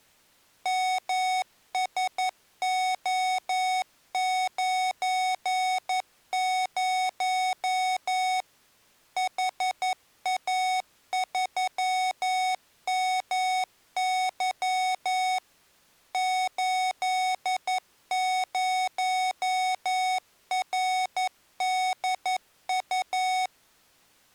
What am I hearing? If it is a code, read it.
Morse code, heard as electronic beeps, machine-sent, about 11 wpm, 740 Hz. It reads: MSO90 HA3MY 80RDU